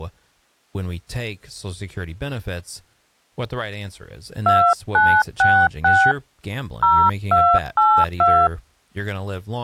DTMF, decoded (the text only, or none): 2966 0282